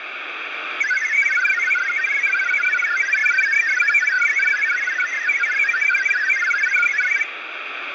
Multi-tone FSK (Olivia or MFSK type), about 1000 Hz wide, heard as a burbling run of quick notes, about 62.5 baud, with radio static.